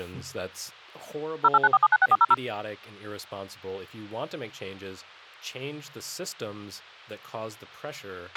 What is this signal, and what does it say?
DTMF, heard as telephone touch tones, dialled by machine, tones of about 40 ms, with a squelch burst at the end and speech in English. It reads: 0894796400